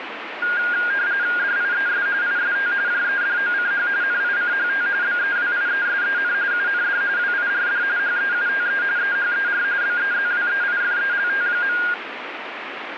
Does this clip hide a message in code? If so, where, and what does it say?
Yes: RTTY (45.45 baud, 170 Hz shift) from 0.4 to 11.9 s, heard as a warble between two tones, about 1500 Hz centre, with radio static. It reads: DIES IST JEDOCH NICHT BEWIESEN UND WIRD HEUTE EHER BEZWEIFELT.